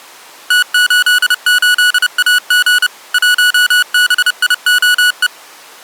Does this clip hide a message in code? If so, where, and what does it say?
Yes: Morse code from 0.4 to 5.3 s, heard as electronic beeps, machine-sent, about 30 wpm, 1470 Hz. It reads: T88AG 1BIOE